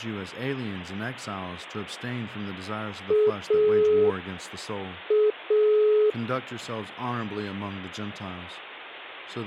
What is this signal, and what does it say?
Telephone call progress tone (pulsed, as in Italy), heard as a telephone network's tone, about 420 Hz, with speech in English. Dial tone.